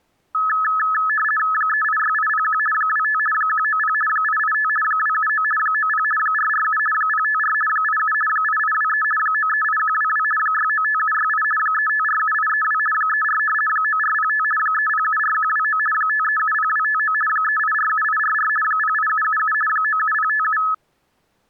RTTY (50 baud, 450 Hz shift), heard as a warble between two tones, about 1500 Hz centre. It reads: 386801 25 190 885 279 90 447 054 87 8823 938122 695768 3547832 34 9405 3074129 5370259 3847844 08777 97057